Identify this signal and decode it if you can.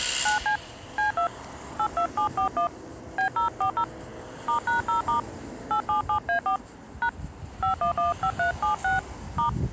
DTMF, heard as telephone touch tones, dialled by hand, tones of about 110 ms, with street noise. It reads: 9C C2 82741 B040 *#0* 877A4 # 5115376 *